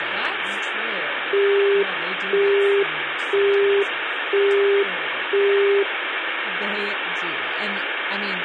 Telephone call progress tone (single-tone plan, as in Europe, Japan and elsewhere), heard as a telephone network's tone, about 400 Hz, 0.5 s on and 0.5 s off, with phone line noise and speech in English. Busy tone.